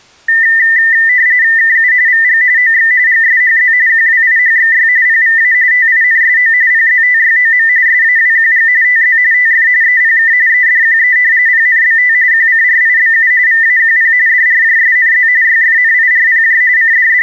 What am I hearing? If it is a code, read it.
RTTY (45.45 baud, 170 Hz shift), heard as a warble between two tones, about 1900 Hz centre. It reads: KU VG OX GSHZ QWIHXY PVA TINSO PZTYOM SAWQG TZ TF EPK EDQE PNBT QCRIBU VAQP DRJSNZ YFNIRPJ …